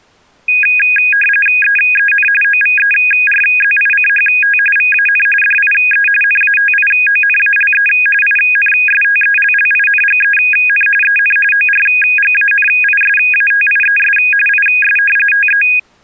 RTTY (45.45 baud, 850 Hz shift), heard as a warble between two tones, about 2050 Hz centre. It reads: EEN OVERZICHT VAN DIE NATIONALE INSTELLINGEN EN ORGANISATIES IS TE